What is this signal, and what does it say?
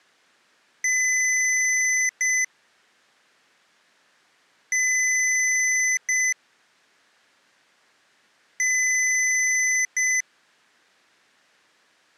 Beep code, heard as beeps from a small speaker, played three times, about 2000 Hz. 1 long, 1 short. In IBM BIOS tables: system board problem.